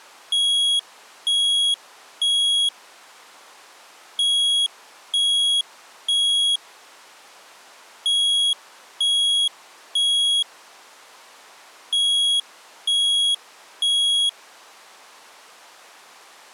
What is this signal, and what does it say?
Alarm pattern, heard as an alarm's beeps, played four times, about 3300 Hz. Temporal three. Smoke or fire, evacuate.